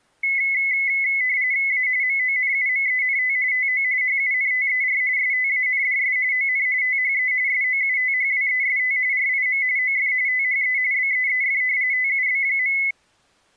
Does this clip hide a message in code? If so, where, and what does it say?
Yes: RTTY (45.45 baud, 170 Hz shift) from 0.2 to 12.9 s, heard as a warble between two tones, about 2100 Hz centre. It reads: A MONUMENT TO HUNTER STANDS ON THE SOUTHWEST RIM OF THE BEEF TUB.